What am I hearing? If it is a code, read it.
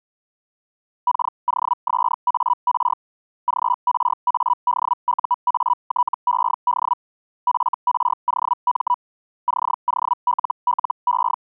Hellschreiber (Feld-Hell, 122.5 baud), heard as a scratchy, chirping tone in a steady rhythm, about 980 Hz. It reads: KOSAR GRADUATED FROM …